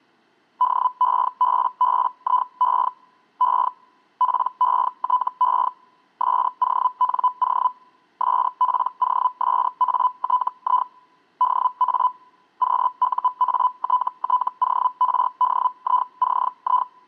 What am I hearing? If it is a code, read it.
Hellschreiber (Feld-Hell, 122.5 baud), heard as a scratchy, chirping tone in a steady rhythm, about 1000 Hz. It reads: DEBBIE E PETE SONO SPOSATI DA QUATTORDICI